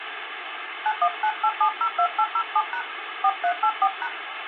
DTMF, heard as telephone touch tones, dialled by hand, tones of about 70 ms, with phone line noise. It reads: 9198702807# 4384#